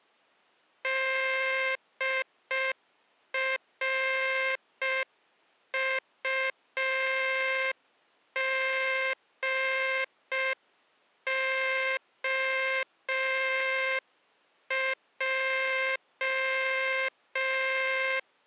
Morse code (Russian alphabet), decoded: ДРУГОЙ

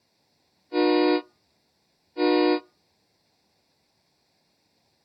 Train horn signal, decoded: 2 short

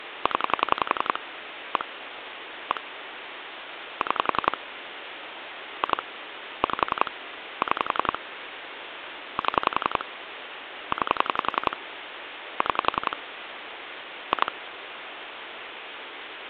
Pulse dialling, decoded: 0 1 1 6 2 5 6 7 9 6 2

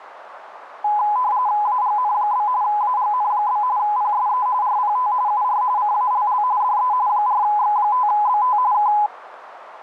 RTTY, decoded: AGN? AGN? PSE RPT UR CALL DE 4X5BT K

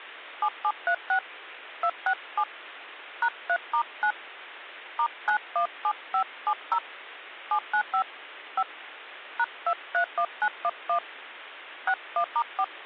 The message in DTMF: 7736 267 #3*9 *917570 795 5 #231911 61*4

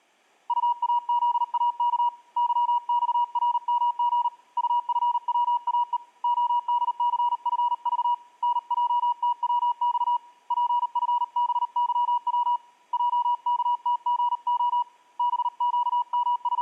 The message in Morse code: UAZAK YXRMG UFWAE ODCFV NJTWX PFBYW JKTGO …

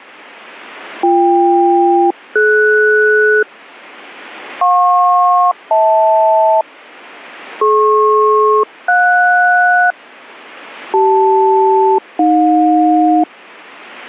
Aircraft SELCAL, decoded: BK-DS JP-HL DP-JS CL-AJ

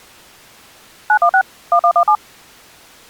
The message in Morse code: none

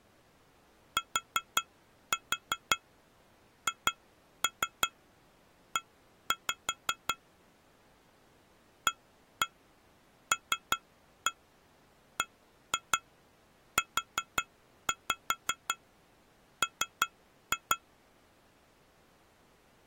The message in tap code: THE ALBUM

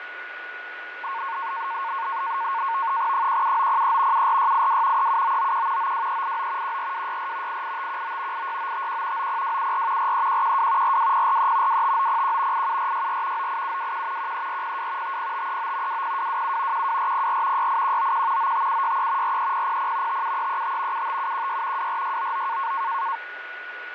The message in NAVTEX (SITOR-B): 17903 74682 37991 92389 14264 88519 86951 90274 43112 42043 25901 87464 98721 13402 50539 20227 12404 68191 95763 43000 57335 75716 24699

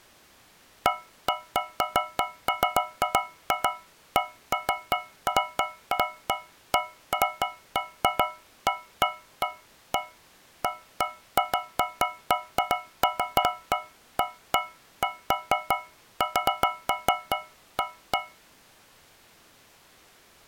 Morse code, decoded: none

